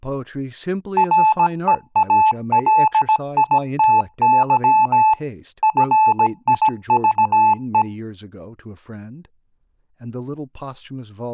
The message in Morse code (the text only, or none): REALITY FIVE